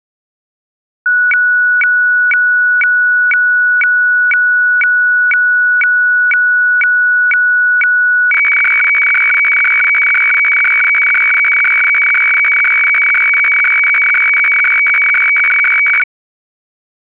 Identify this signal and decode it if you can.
Weather fax (radiofax), 120 lines a minute, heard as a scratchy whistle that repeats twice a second.